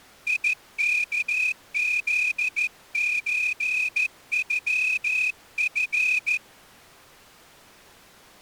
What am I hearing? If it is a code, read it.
Morse code (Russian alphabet), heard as a whistle, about 14 wpm. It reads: ИКЗЧЮФ